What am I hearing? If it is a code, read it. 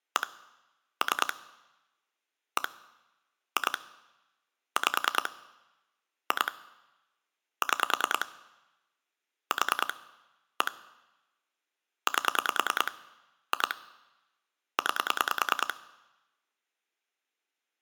Pulse dialling, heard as clicks on a phone line, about 10 pulses a second. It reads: 1 3 1 2 5 2 6 4 1 8 2 9